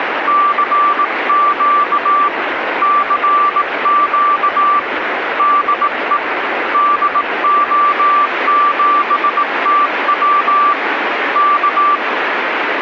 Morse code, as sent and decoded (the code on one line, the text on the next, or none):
-.-. --.- / -.-. --.- / -.. . / -.. --- --... - .-- / -.-
CQ CQ DE DO7TW K